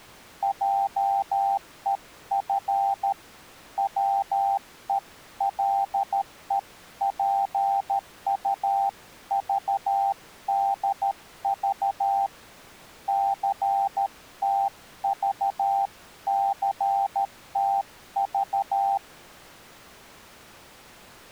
Morse code (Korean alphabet), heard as a keyed tone, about 13 wpm, 790 Hz. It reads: 한 바가지를 철철